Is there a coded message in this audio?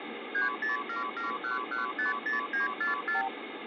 Yes: multi-frequency trunk signalling (R2, with the far end's replies) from 0.3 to 3.3 s, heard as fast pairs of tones, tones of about 140 ms, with phone line noise. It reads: 30771150944